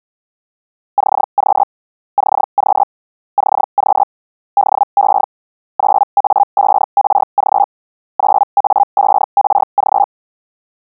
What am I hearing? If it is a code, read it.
Hellschreiber (Feld-Hell, 122.5 baud), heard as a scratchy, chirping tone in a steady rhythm, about 810 Hz. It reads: CQ CQ CQ DE 9A5RG 9A5RG